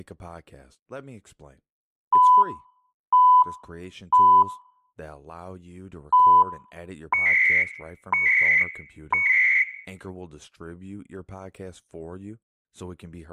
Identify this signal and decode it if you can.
Radio time signal (CHU, Canada), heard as beeps and data bursts, one a second, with room echo and speech in English.